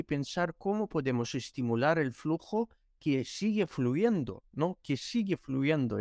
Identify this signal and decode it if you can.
Speech in Spanish. There is no code.